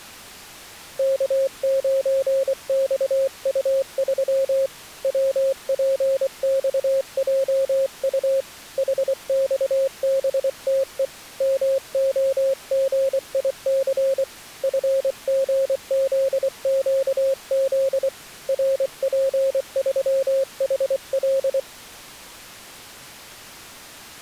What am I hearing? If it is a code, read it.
Morse code, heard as a keyed tone, hand-sent with a paddle, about 24 wpm, 540 Hz. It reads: K9XU3 WPXJU HXBTE MOGIC FGZQZ RP3HL